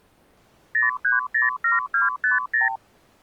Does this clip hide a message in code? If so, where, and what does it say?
Yes: multi-frequency trunk signalling (R2, with the far end's replies) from 0.7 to 2.8 s, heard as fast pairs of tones, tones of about 150 ms. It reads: 0307250